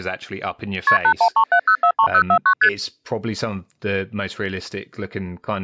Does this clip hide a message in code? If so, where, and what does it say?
Yes: multi-frequency trunk signalling (R1, as on North American trunks) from 0.9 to 2.7 s, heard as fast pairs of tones, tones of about 80 ms, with speech in English. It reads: KP 8137043049 ST